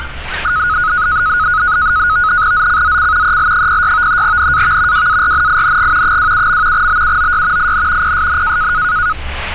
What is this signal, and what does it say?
NAVTEX (SITOR-B), 100 baud, 170 Hz shift, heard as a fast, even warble, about 1360 Hz centre, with street noise. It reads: ZCZC EL06 NAV WARNING 27. BUOY IN PSN